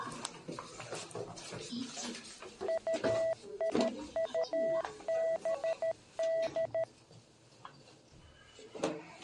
Morse code, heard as a keyed tone, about 13 wpm, 660 Hz, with the noise inside a lift. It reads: UIUBD